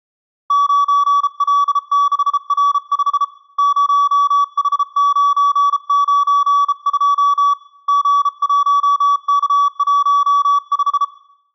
Morse code, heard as a keyed tone, hand-sent with a bug key, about 33 wpm, 1140 Hz, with room echo. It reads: 9L6R5 0H992 G1K15